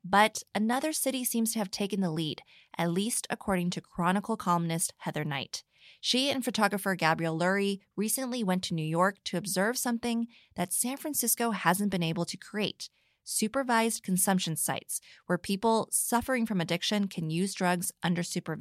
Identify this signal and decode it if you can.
Speech in English. There is no code.